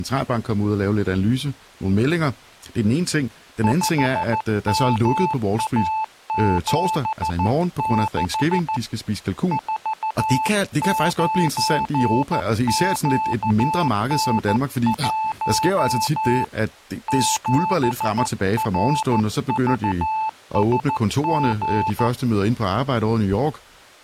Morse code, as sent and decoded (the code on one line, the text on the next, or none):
..... -- .- --... -.... / ....- ----. --.- -. .---- / --... .-. ...- ... --.
5MA76 49QN1 7RVSG